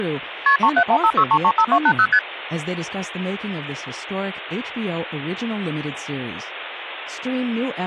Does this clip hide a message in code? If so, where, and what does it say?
Yes: multi-frequency trunk signalling (R1, as on North American trunks) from 0.5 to 2.2 s, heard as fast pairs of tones, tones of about 70 ms, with phone line noise and speech in English. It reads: KP 37156335280 ST